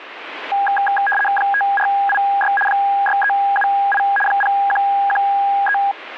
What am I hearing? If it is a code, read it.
RTTY (75 baud, 850 Hz shift), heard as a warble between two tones, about 1220 Hz centre, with radio static. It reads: 5486 6378 0113